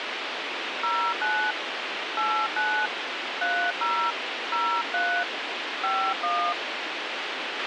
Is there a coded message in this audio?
Yes: DTMF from 0.8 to 6.5 s, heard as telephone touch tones, dialled by hand, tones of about 290 ms, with radio hiss and a squelch burst at the end. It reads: 09 89 30 03 51